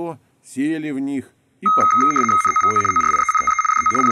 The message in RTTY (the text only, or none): NOVO ORIENTE DO …